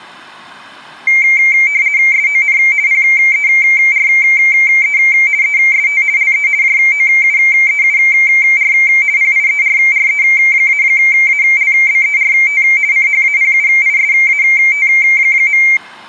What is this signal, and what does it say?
RTTY (50 baud, 170 Hz shift), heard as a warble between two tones, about 2200 Hz centre. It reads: SON PERE EST LE JOUEUR PIERRE-ALBERT CHAPUISAT.